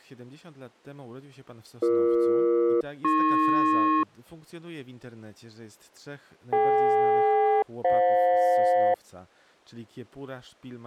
Aircraft SELCAL, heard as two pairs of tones, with speech in Polish. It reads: BE-AP DK-FJ